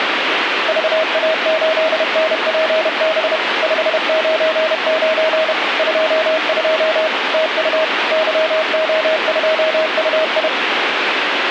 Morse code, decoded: VA8NPB 599 22 TU YO2UI

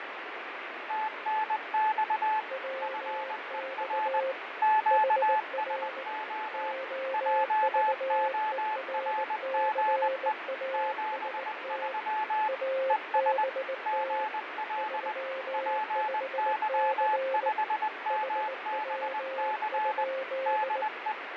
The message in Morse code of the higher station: TNX FER QSO JORGE 73 ES GL PY5MBC DE

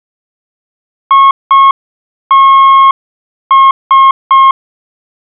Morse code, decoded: ITS

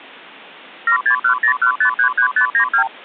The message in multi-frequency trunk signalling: 76101533592

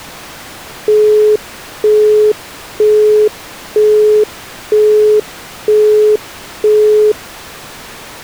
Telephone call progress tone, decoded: busy tone

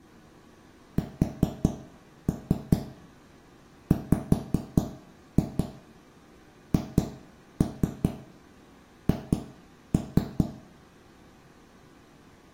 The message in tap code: SWHH

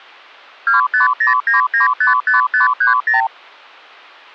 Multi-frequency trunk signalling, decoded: 2509955530

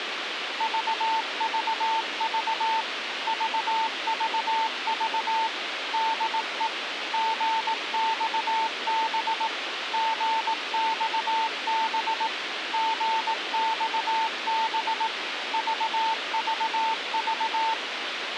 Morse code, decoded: VVV VVV DE GXB GXB GXB VVV

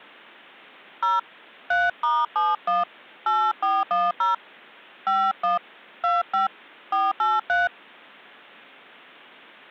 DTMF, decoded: 0 3*71 8410 51 25 483

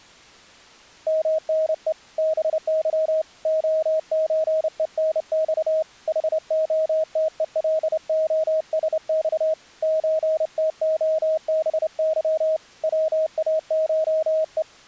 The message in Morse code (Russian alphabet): МНЕ БЫ ОЧЕНЬ ХОТЕЛОСЬ ЧТОБЫ ВАШЕ

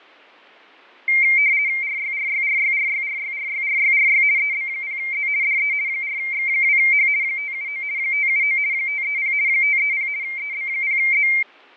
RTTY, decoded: RYRYRYRYRYRYRYRY EB0Z DE 4X2H 579 579 530 530 EB0Z

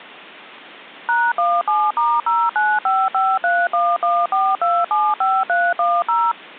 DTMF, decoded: #17*09553114275310

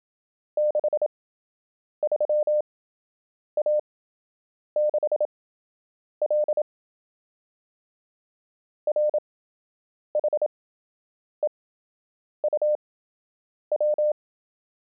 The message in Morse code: 63A6L RHEUW

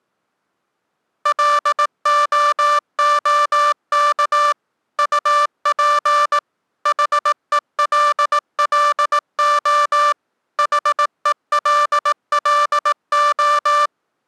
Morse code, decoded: LOOK UP HELLO HELLO

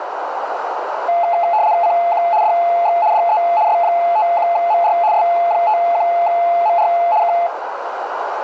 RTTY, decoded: CQ DX DE S51MR S51MR K

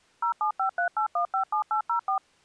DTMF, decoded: 07538157804

